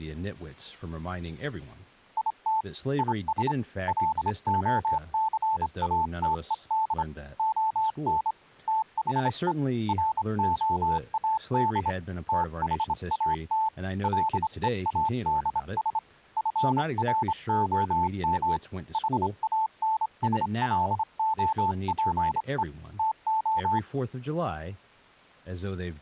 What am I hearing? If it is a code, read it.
Morse code, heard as a keyed tone, hand-sent with a straight key, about 26 wpm, 880 Hz, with speech in English. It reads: IT IS LOCATED ON THE ROAD THAT LEADS FROM HANSLOPE TO